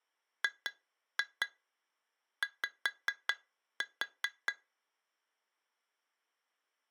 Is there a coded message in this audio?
Yes: tap code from 0.4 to 4.6 s, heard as taps on glass, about 4 knocks a second. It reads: GY